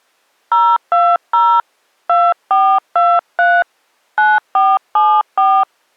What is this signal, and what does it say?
DTMF, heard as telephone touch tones, dialled by hand, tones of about 240 ms. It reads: 020 2423 9474